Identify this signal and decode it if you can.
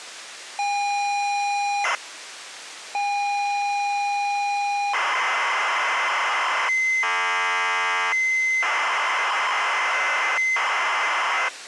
ZX Spectrum tape loading, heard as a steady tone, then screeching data.